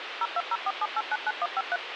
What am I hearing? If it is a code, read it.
DTMF, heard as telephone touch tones, dialled by machine, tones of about 40 ms, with phone line noise. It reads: 02047899153